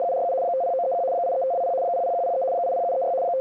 RTTY (75 baud, 170 Hz shift), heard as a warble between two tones, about 610 Hz centre. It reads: … 50931 83520 00103 80736 …